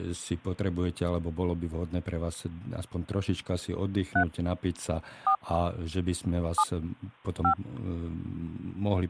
DTMF, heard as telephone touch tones, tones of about 80 ms, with speech in Slovak. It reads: 3 4 7 5